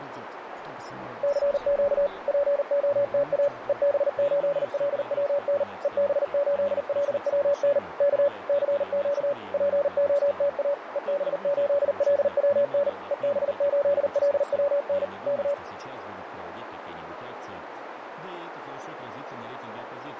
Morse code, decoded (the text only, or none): CQ POTA EB8LWN EB8LWN K CQ POTA EB8LWN EB8LWN K